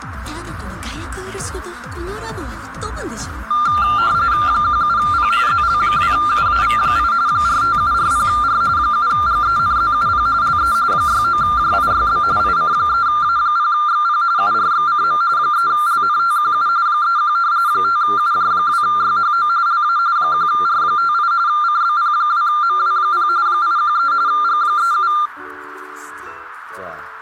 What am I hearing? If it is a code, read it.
RTTY (45.45 baud, 170 Hz shift), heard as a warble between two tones, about 1290 Hz centre, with radio static. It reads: 17P ZL2UAV8 45740R 7GENZUP LE 69JIYB IC3A0XP URXCM 3LNTQU 31 5UJ2YHO LA 1R58 CBP2MW0 813 G37